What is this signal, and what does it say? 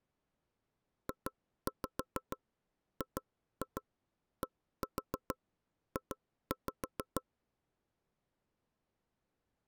Tap code, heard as knocks on wood, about 6 knocks a second. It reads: JGDJ